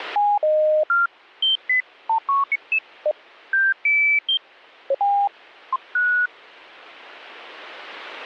Electronic bleeps of random pitch and length. There is no code.